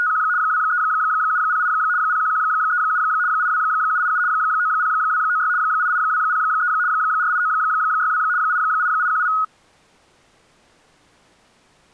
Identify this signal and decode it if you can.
RTTY (75 baud, 170 Hz shift), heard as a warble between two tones, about 1360 Hz centre. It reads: … 23708 01137 82787 90296 88203 48962 88818